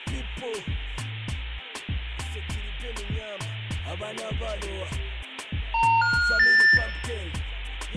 Telephone call progress tone (North American plan), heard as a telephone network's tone, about 910, 1430, 1800 Hz, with room echo. Special information tone.